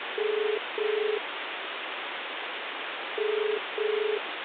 Telephone call progress tone (as in the UK, Ireland, Australia and similar networks), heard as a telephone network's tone, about 430 Hz, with phone line noise. Ringback tone.